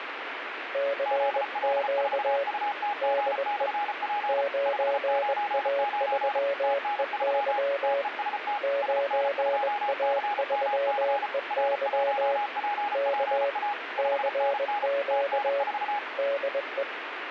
Morse code, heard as two keyed tones, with radio static. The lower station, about 21 wpm, 560 Hz: CQ DE 9A3EY 9A3EY K CQ DE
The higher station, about 34 wpm, 820 Hz: ZL4UTG/P 599 TN3 TEST SN2CMC R1PPA 5NN TN4